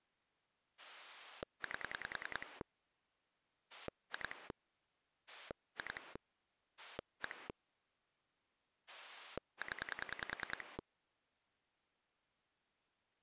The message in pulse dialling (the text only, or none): 8 2 2 1 0